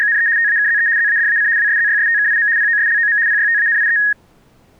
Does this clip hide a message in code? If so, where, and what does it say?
Yes: RTTY (75 baud, 170 Hz shift) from 0.0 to 4.1 s, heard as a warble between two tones, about 1750 Hz centre. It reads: … TAKZE ZADAC WSZYSTKIM POSLOM PYTANIE